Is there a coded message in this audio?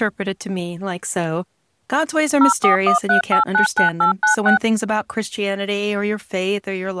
Yes: DTMF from 2.4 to 4.6 s, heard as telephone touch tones, dialled by machine, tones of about 120 ms. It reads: 0413899896